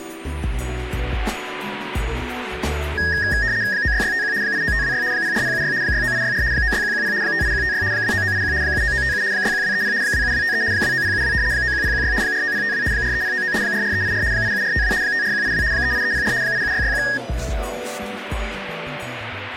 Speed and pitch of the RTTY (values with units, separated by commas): 75 baud, 170 Hz shift, 1750 Hz centre